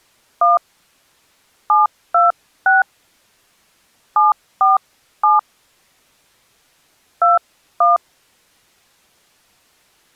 DTMF, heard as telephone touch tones, dialled by hand, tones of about 160 ms. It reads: 1 726 747 21